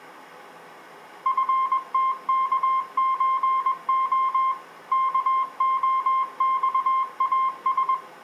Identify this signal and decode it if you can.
Morse code (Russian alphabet), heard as a keyed tone, machine-sent, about 21 wpm, 1060 Hz. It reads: ФТКЧО КОЬАС